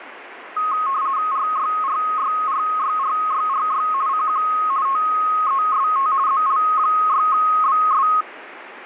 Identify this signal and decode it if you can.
RTTY (50 baud, 170 Hz shift), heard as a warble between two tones, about 1170 Hz centre, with radio static. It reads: RYRYRYRYRY CQ TEST ZL6BS